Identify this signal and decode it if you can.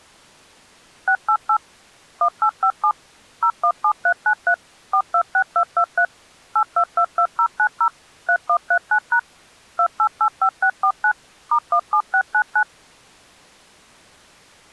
DTMF, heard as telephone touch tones, dialled by machine, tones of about 80 ms. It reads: 688 1857 017393 426223 8222090 3139# 2885649 *17699